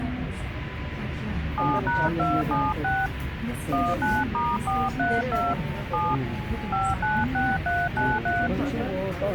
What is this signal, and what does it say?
DTMF, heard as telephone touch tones, dialled by hand, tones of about 220 ms, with radio hiss and the noise inside a subway train. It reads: 7#276 19*432 7 596393